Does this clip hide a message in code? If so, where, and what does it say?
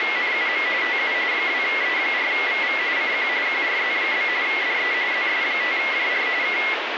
Yes: RTTY (45.45 baud, 170 Hz shift) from 0.0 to 6.7 s, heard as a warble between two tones, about 2050 Hz centre, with radio static. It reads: … TU 2E4VV CQ QRZ? DE ZS5JR K